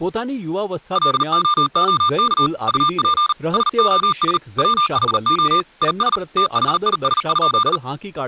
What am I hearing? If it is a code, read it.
Morse code, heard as electronic beeps, machine-sent, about 39 wpm, 1200 Hz, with speech in Gujarati. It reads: LOOK UP SOS WHO IS THIS?